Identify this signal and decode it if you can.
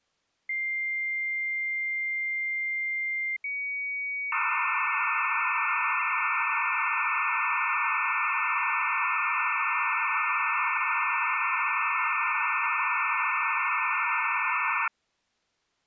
Dial-up modem handshake (low-speed, two carriers), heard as two whistles, then hiss.